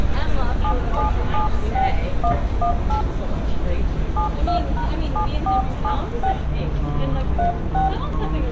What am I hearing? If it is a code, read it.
DTMF, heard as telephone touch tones, dialled by hand, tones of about 110 ms, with room echo and street noise. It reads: 7776118 72#7476 36